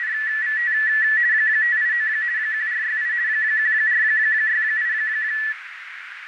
RTTY (50 baud, 170 Hz shift), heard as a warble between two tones, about 1850 Hz centre, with radio static and a narrow filter. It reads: … 589 1468 1468